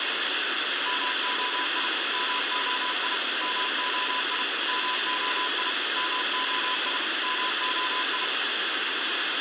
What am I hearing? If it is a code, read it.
Morse code, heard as a keyed tone, machine-sent, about 32 wpm, 1000 Hz, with radio hiss and a squelch burst at the end. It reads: MOI MOI MOI MOI MOI MOI